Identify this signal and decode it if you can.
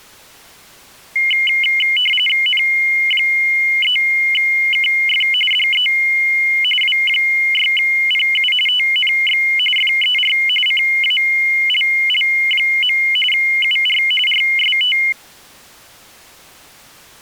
RTTY (45.45 baud, 850 Hz shift), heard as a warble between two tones, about 2550 Hz centre. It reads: N3KF DE W6PU TNX FER CALL. UR RST